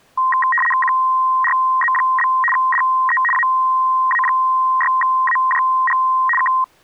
RTTY (75 baud, 850 Hz shift), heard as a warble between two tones, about 1460 Hz centre. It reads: QRZ? DE AA6AJG K